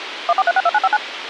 DTMF, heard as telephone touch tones, dialled by machine, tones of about 40 ms, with radio hiss and a squelch burst at the end. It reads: 14362959